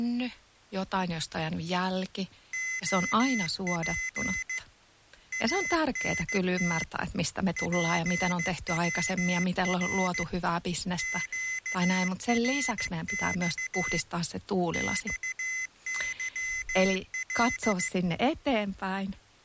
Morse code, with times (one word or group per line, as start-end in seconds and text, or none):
2.5-4.6 OP
5.3-6.8 ANT
7.6-10.2 PWR
11.0-14.0 QRX
14.7-17.9 XYL